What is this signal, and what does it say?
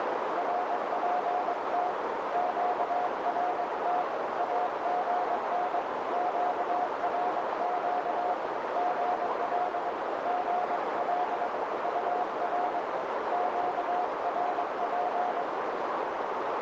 Morse code, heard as a keyed tone, hand-sent with a paddle, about 22 wpm, 720 Hz, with heavy radio static and a narrow filter. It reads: RPT QRT AGN QRQ GL GL UR QRP